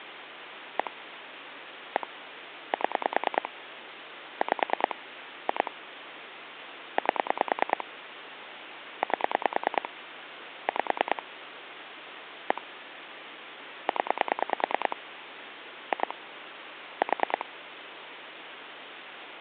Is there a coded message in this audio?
Yes: pulse dialling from 0.8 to 17.4 s, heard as clicks on a phone line, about 9 pulses a second, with phone line noise. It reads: 1 1 7 5 2 8 8 5 1 0 2 4